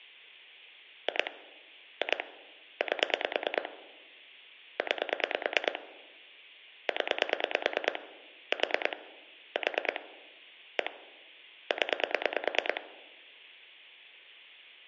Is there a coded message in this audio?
Yes: pulse dialling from 1.1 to 12.8 s, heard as clicks on a phone line, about 9 pulses a second. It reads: 2 2 8 9 0 4 4 1 0